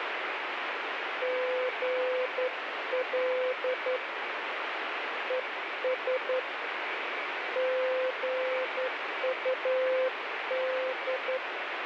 Morse code, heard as a keyed tone, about 11 wpm, 510 Hz, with radio static. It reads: GL ES GUD